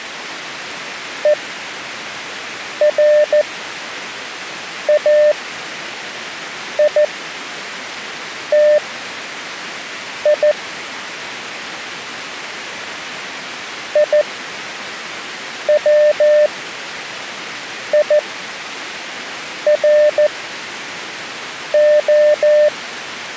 Morse code (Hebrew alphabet), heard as a keyed tone, machine-sent, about 14 wpm, spaced as for 5 wpm, 600 Hz. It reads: וראיתי יצירה